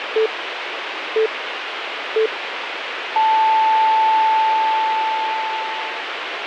Radio time signal (three low pips and a long one an octave up, as on NHK), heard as pips, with radio hiss.